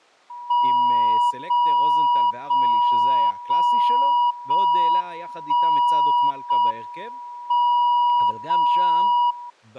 Radio time signal (JJY), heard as a tone whose level steps once a second, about 970 Hz, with speech in Hebrew. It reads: 0 0 0 0 1 0 M 0 0